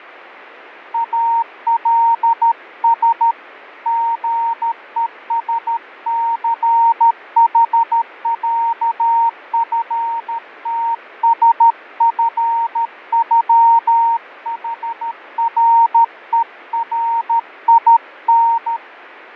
Morse code (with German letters), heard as a keyed tone, hand-sent with a paddle, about 13 wpm, 920 Hz, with radio static and fading. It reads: ALS GESCHÄFTSFÜHRERIN